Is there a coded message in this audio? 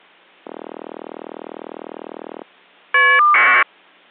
Yes: caller ID data burst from 0.4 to 3.6 s, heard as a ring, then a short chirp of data, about 1200 baud.